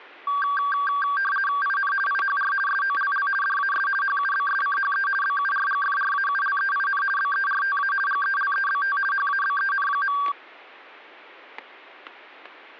RTTY (50 baud, 450 Hz shift), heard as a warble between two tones, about 1360 Hz centre, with static crashes. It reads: IN IHR SOLL DAS HUBSCHE BURGFRAULEIN BERTA GELEBT HABEN.